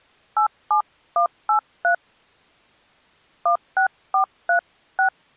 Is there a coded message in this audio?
Yes: DTMF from 0.4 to 5.1 s, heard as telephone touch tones, dialled by hand, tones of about 100 ms. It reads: 87183 16436